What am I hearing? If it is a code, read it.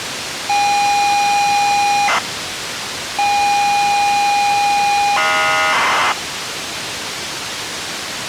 ZX Spectrum tape loading, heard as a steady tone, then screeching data, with tape hiss.